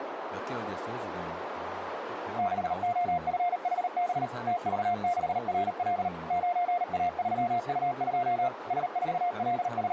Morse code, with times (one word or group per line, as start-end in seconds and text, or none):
2.4-4.3 6OFHB
4.5-6.1 TV6RL
6.3-8.5 9A3U2
8.7-9.9 …